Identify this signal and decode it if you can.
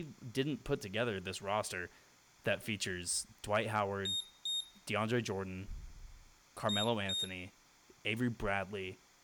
Beep code, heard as a piezo beeper, played twice, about 3700 Hz, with room echo and speech in English. 2 short. In AMI BIOS tables: memory parity error; in IBM BIOS tables: self-test error shown on screen; in Dell tables: no memory detected.